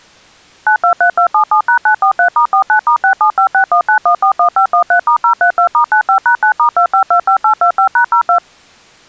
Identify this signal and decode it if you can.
DTMF, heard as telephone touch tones, dialled by machine, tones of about 90 ms. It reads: 923277#943*49*675619141513*032*95#9*2525825#02